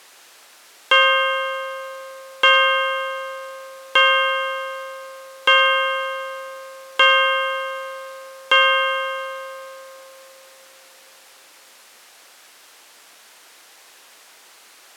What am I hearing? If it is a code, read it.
Clock strike, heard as a bell. 6. Six o'clock.